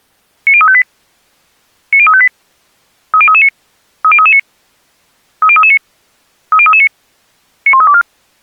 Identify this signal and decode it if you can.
Five-tone selective call (ZVEI), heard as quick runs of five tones, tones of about 70 ms. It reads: 90358 90358 30339 30339 30339 30339 91324